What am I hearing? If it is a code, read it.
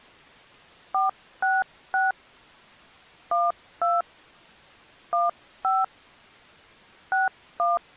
DTMF, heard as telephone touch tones, dialled by hand, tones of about 180 ms. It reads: 466 12 15 61